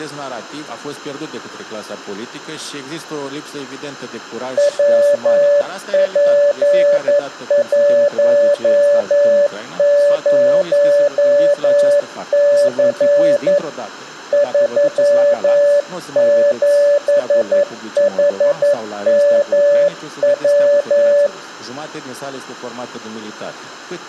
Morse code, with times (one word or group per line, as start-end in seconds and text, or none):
4.6-13.6 WP10C
14.3-21.3 37HMW